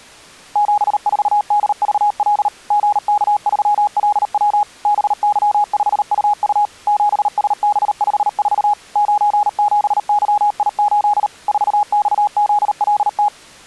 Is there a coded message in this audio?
Yes: Morse code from 0.5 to 13.3 s, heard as a keyed tone, machine-sent, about 38 wpm, 830 Hz. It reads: 74DVL GK3LW BY5UU 7SB54 97YI8 4XZLT